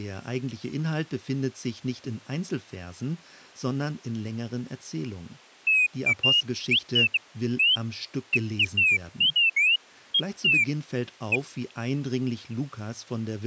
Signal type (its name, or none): none